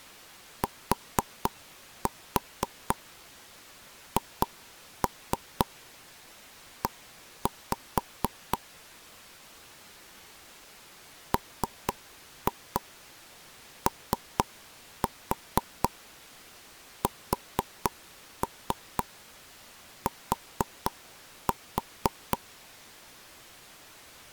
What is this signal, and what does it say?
Tap code, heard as taps on a table, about 4 knocks a second. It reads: THE MOST